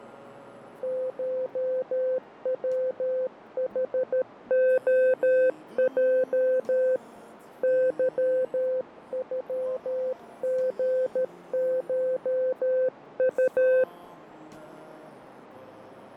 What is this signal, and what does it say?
Morse code (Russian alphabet), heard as a keyed tone, hand-sent with a paddle, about 13 wpm, 520 Hz, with radio static and fading. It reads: ШВХОЙ ЫЮГШУ